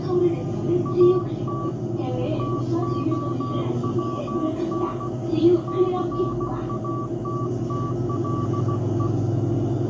Morse code, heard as a keyed tone, hand-sent with a paddle, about 16 wpm, 1150 Hz, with the noise inside a bus. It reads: AT TOWN CATTLE